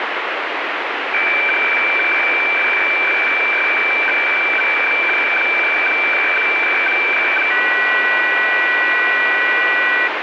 Weather fax (radiofax), 120 lines a minute, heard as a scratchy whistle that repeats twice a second, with radio static.